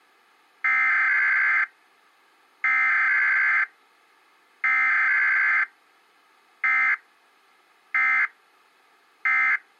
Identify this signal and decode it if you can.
Emergency Alert System (SAME) tones (header bursts, then end-of-message bursts), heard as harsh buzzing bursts, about 520.83 baud.